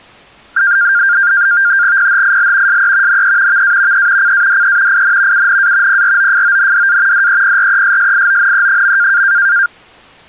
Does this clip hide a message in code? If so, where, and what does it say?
Yes: NAVTEX (SITOR-B), 100 baud, 170 Hz shift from 0.6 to 9.7 s, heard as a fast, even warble, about 1500 Hz centre. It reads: PHIL SE NE VA E CADE IN UNA PROFONDA DEPRESSIONE.